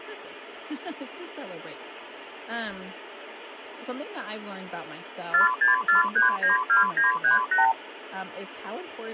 Multi-frequency trunk signalling (R2, with the far end's replies), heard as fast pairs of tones, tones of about 140 ms, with speech in English. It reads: 464392938